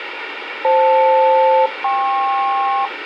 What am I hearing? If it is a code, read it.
Aircraft SELCAL, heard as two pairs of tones, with radio hiss. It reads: FL-KP